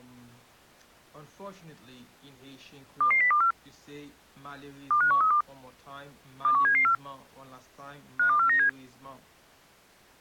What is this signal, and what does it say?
Five-tone selective call (CCIR), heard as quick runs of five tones, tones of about 100 ms. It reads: 22024 25132 21774 52497